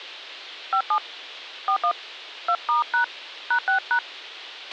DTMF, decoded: 57 41 2*# #6#

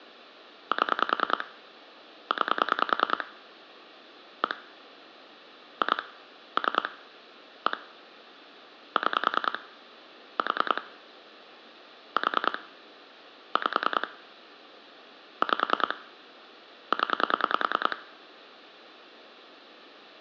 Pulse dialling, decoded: 7 9 1 2 3 1 6 4 4 5 5 0

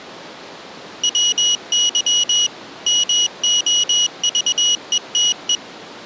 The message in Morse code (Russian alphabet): ВЫ МОЖЕТЕ

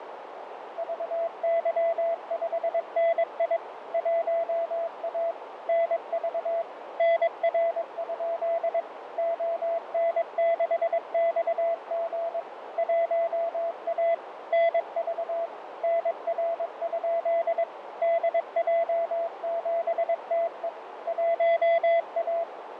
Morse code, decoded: VY5NI 1A NV NR? ON6XG 1A NV NR? DJ7TE 1A

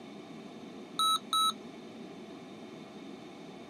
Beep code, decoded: 2 short

